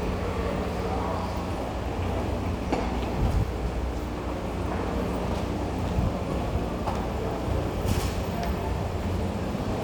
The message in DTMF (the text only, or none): none